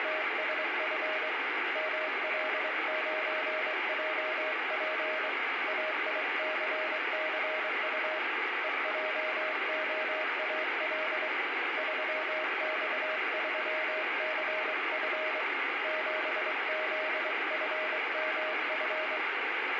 Morse code, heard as a keyed tone, hand-sent with a straight key, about 23 wpm, 620 Hz, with radio static and room echo. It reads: … ML9JP AICCU EJOAL 3X3CF 7ZFMF